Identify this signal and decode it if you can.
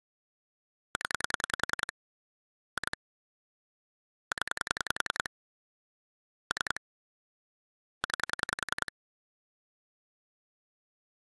Pulse dialling, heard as clicks on a phone line, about 10 pulses a second. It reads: 0 2 0 3 9